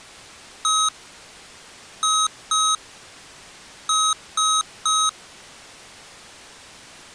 Beep code, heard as beeps from a small speaker, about 1270 Hz. 1-2-3. In Phoenix BIOS tables: DMA page register failure.